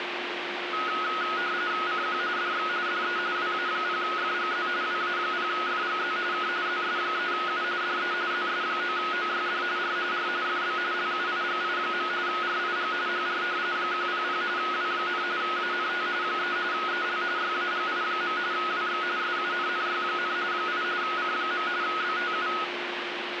RTTY (45.45 baud, 170 Hz shift), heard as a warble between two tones, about 1360 Hz centre, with radio static and a steady whistle near 350 Hz. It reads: CQ DX DE WA0FGZ WA0FGZ K ZS3U DE ZS9OYD R R FB LUIGI. RIG HR 100 W, ANT 3 EL YAGI. WX SUNNY, 8 C. BTU